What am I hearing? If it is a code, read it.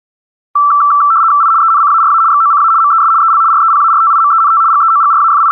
RTTY (75 baud, 170 Hz shift), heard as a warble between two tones, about 1240 Hz centre. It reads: I ENCARA XOCA MES EL REPARTIMENT …